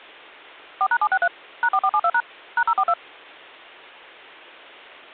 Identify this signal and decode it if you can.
DTMF, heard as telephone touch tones, dialled by machine, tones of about 60 ms. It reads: 4#763 #4472# #042